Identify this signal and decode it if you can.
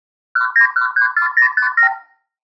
Multi-frequency trunk signalling (R2, with the far end's replies), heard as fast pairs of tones, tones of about 100 ms. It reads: 19134057